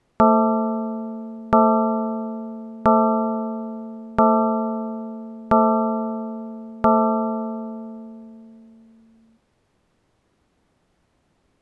Clock strike, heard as a bell. 6. Six o'clock.